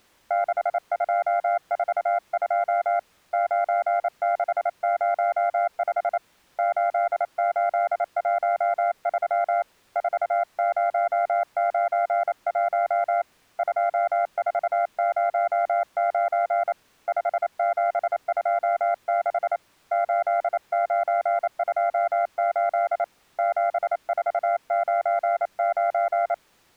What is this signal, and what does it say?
Morse code, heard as a keyed tone, hand-sent with a paddle, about 28 wpm, 690 Hz. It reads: 6242 9605 8813 4091 2409 5726 8928 7499